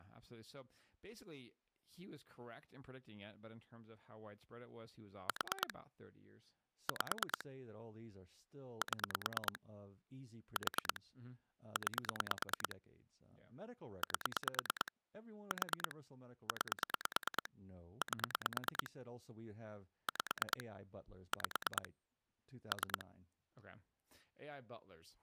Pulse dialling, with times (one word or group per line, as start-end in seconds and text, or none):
5.3-5.7 4
6.9-7.4 5
8.8-9.6 7
10.6-11.0 4
11.8-12.8 9
14.0-14.9 8
15.5-16.0 4
16.5-17.5 9
18.0-18.9 8
20.1-20.6 5
21.3-21.9 5
22.7-23.1 3